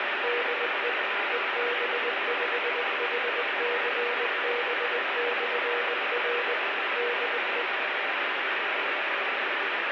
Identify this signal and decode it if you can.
Morse code, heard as a keyed tone, machine-sent, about 20 wpm, 480 Hz, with heavy radio static. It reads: DE EB5HCB/R DE